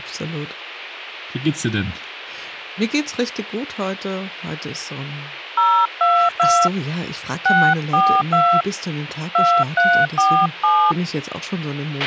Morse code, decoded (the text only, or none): none